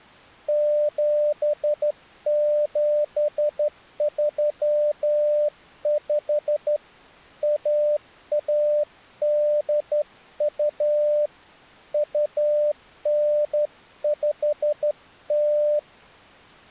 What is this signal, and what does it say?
Morse code (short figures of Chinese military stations), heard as a keyed tone, hand-sent with a straight key, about 12 wpm, 600 Hz. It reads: 7735 1182 2950